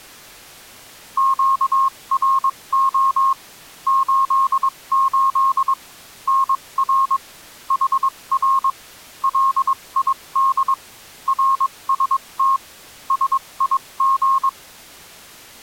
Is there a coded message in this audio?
Yes: Morse code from 1.1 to 14.6 s, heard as a keyed tone, machine-sent, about 22 wpm, spaced as for 19 wpm, 1080 Hz. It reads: QRO 88 NR HR LID RST SIG